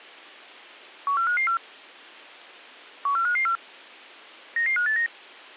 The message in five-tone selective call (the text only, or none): 14554 14554 99589